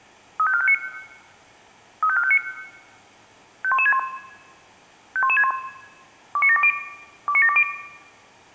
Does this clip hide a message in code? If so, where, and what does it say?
Yes: five-tone selective call (ZVEI) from 0.4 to 7.6 s, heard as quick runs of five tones, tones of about 70 ms, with room echo. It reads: 35459 35459 51161 51161 29720 29720